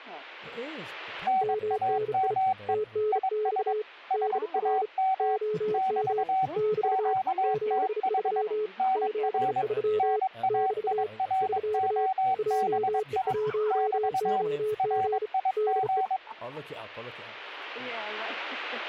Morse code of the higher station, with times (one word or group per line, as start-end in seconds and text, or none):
1.3-2.7 NAME
3.1-3.7 IS
4.1-5.4 SAM
5.7-6.5 <BT>
6.8-8.4 QTH
8.8-9.6 NR
10.0-13.3 NAIROBI
13.7-14.4 <BT>
14.8-16.2 RIG